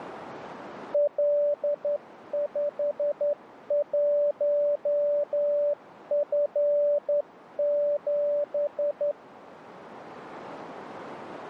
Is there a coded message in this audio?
Yes: Morse code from 0.9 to 9.2 s, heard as a keyed tone, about 11 wpm, 580 Hz, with radio static. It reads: L51F7